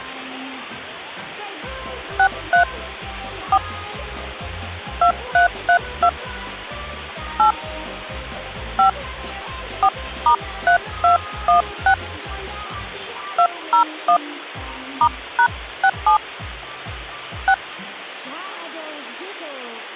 DTMF, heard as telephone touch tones, dialled by hand, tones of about 90 ms. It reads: 63 4 2332 8 5 4*3216 201 *#67 6